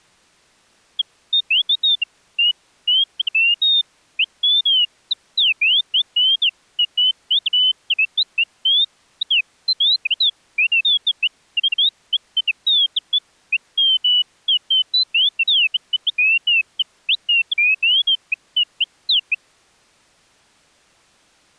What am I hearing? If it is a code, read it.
Bird-like chirps. There is no code.